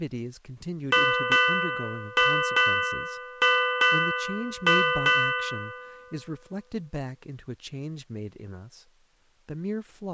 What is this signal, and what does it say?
Ship's bell, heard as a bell, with speech in English. 8. Eight half-hours of the watch have passed.